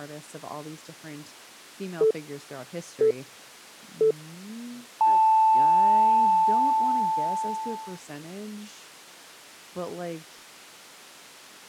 Radio time signal (three low pips and a long one an octave up, as on NHK), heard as pips, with speech in English.